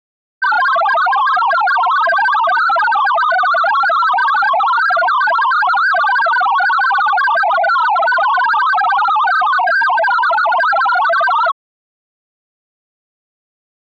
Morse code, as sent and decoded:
none

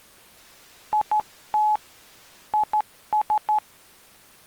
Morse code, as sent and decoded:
.. - / .. ...
IT IS

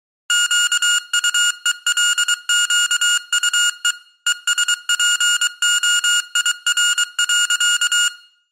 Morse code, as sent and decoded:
--.- ..- . .-.. --.- ..- . / . ... .--. --- .. .-. .-.-.-
QUELQUE ESPOIR.

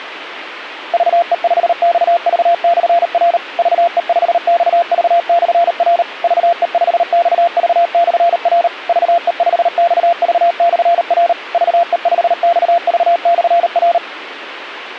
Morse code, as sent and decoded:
...- . ..... -..- ...- -..-. .-. / ...- . ..... -..- ...- -..-. .-. / ...- . ..... -..- ...- -..-. .-. / ...- . ..... -..- ...- -..-. .-. / ...- . ..... -..- ...- -..-. .-.
VE5XV/R VE5XV/R VE5XV/R VE5XV/R VE5XV/R

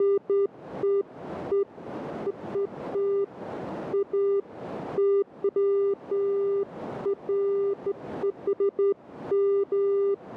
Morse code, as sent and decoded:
none

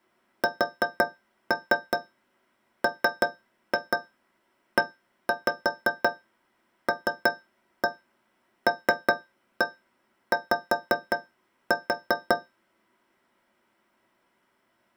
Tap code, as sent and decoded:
4-3 3-2 1-5 3-1 3-1 5-4
SMELLY

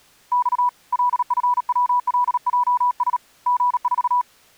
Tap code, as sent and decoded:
none

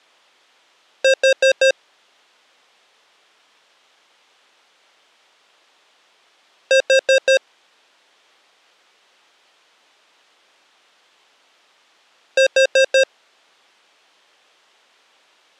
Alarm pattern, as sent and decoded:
4 beeps and a pause
temporal four

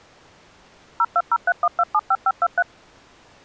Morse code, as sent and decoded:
none

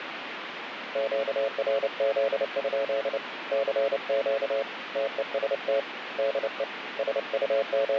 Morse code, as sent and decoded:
--.- .-. --.. ..--.. / -.-. --.- / - . ... - / -.. . / …
QRZ? CQ TEST DE …

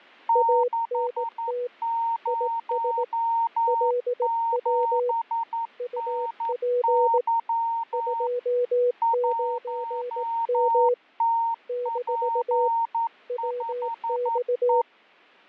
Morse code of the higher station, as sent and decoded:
-.... ----- --... -. -.-- / .---- - .--. ..... .
607NY 1TP5E

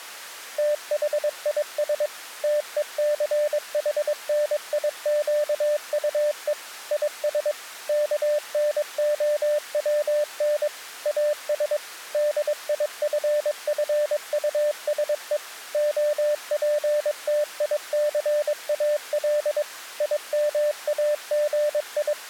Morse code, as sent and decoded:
- .... .. ... / - . -.-. .... -. .. --.- ..- . / .. ... / -.- -. --- .-- -. / .- ... / -.. .. ..-. ..-. ..- ... . / --- .--. - .. -.-. .- .-.. / …
THIS TECHNIQUE IS KNOWN AS DIFFUSE OPTICAL …

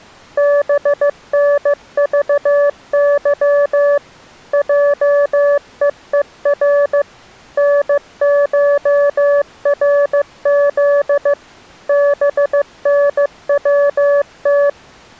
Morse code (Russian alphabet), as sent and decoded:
-... -. ...- -.-- / .--- . . .-. / -. ---- .-. --.. / -... -. .-- -
БНЖЫ ЙЕЕР НШРЗ БНВТ

